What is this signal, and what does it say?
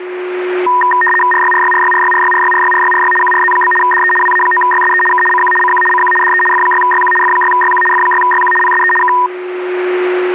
RTTY (75 baud, 850 Hz shift), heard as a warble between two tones, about 1420 Hz centre, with a steady whistle near 360 Hz. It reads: RYRYRYRYRYRYRYRYRY QRZ? DE WA9YSE K CQ CQ CQ DE F6YQ F6YQ F6YQ PSE K